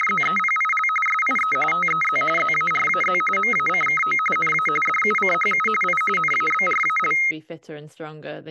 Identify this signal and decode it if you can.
RTTY (45.45 baud, 850 Hz shift), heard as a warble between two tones, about 1700 Hz centre, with speech in English. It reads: … SIE TEZ ZARAZ MACKO NA DUCHU I NABRAL